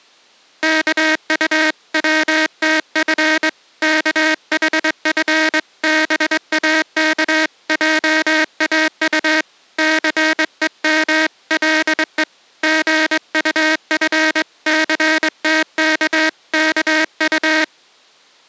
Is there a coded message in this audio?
Yes: Morse code (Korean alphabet) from 0.6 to 17.7 s, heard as a buzzer, hand-sent with a straight key, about 22 wpm. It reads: 이번 운동회 참가 신청이